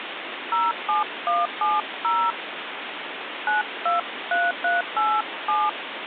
DTMF, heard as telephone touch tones, dialled by hand, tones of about 190 ms, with phone line noise. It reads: 07170 923387